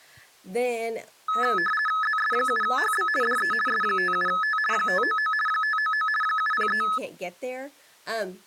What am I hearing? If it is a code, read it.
RTTY (50 baud, 450 Hz shift), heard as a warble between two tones, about 1500 Hz centre, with speech in English. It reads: ZS7HB DE S57T 599 599 703